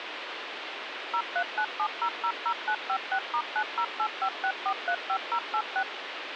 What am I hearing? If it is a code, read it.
DTMF, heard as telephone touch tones, dialled by machine, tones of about 70 ms, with phone line noise. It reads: 0397000956*90856435086